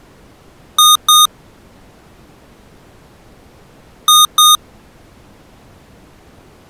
Beep code, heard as beeps from a small speaker, played twice, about 1230 Hz. 2 short. In AMI BIOS tables: memory parity error; in IBM BIOS tables: self-test error shown on screen; in Dell tables: no memory detected.